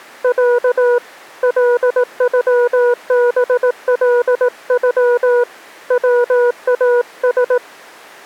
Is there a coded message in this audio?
Yes: Morse code (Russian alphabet) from 0.2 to 7.6 s, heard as a keyed tone, hand-sent with a paddle, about 18 wpm, 480 Hz. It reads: Я ЛЮБЛЮ ВАС